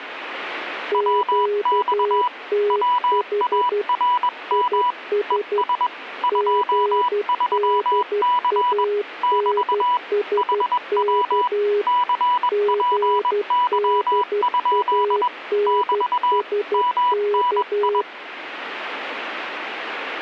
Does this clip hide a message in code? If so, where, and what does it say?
Yes: Morse code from 0.9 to 18.1 s, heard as two keyed tones, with radio static. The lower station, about 12 wpm, 410 Hz: QTH IS GDANSK GDANSK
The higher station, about 21 wpm, 980 Hz: WX WARM ES 23C <BT> HW CPY? <BT> MNI